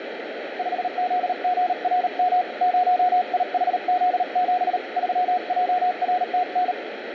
Morse code, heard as a keyed tone, hand-sent with a paddle, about 38 wpm, 720 Hz, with radio static. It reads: 5ZGRM 0IHZ7 3JRTN